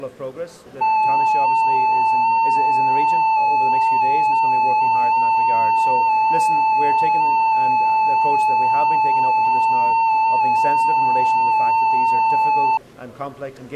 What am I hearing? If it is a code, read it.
FT8 (one signal), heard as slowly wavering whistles, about 6.25 baud.